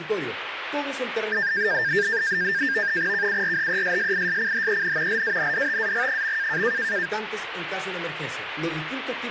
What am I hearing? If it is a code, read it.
NAVTEX (SITOR-B), 100 baud, 170 Hz shift, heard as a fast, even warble, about 1700 Hz centre, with radio static. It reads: KURHESSISCHEN LANDTAG.